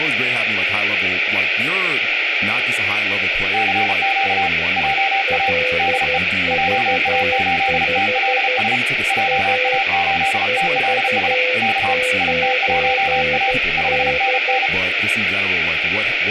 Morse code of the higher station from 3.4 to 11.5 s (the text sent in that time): CQ JA DE JA8TLS JA8TLS